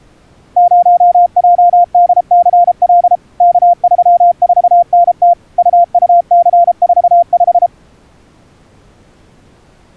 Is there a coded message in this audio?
Yes: Morse code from 0.5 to 7.7 s, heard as a keyed tone, machine-sent, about 33 wpm, 690 Hz. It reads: 0JDCL K34NT UUC45